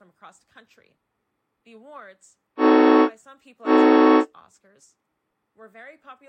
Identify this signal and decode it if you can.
Train horn signal, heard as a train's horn, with speech in English. 2 short. On North American railways: a signal is acknowledged.